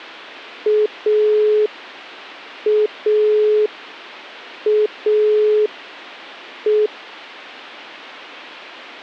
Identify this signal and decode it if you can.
Telephone call progress tone (pulsed, as in Italy), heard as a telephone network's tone, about 420 Hz. Dial tone.